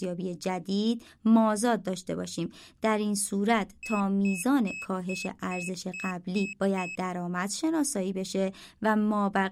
Beep code, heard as a piezo beeper, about 2600 Hz, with speech in Persian. 8 short. In AMI BIOS tables: display memory failure; in Dell tables: LCD failure.